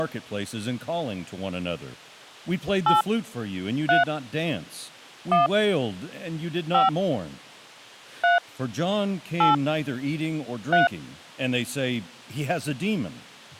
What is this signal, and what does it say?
DTMF, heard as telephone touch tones, dialled by hand, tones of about 150 ms, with speech in English. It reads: 8 3 1 5 3 8 3